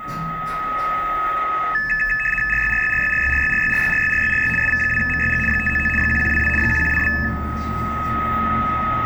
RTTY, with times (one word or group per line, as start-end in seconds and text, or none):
2.5-4.5 RYRYRYRYRYRYRYRYRYRY
4.6-5.4 SV2MYG
5.5-5.9 599
6.0-6.5 1122
6.6-7.1 1122